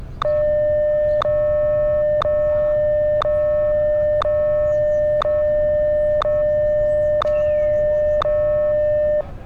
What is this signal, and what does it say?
Radio time signal (WWVH, Hawaii), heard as ticks, one a second, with street noise.